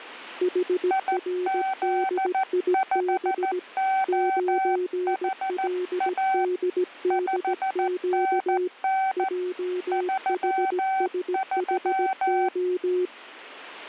Morse code, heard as two keyed tones. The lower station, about 17 wpm, 360 Hz: HRDIB 9LDDQ JHSHO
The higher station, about 14 wpm, 770 Hz: IZ5OHA 5NN 33